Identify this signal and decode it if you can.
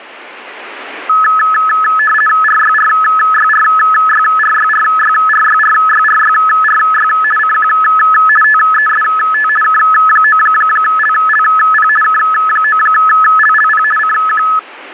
RTTY (50 baud, 450 Hz shift), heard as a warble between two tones, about 1500 Hz centre. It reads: RYRYRYRYRYRYRYRYRY CQ TEST K9LLP K9LLP CQ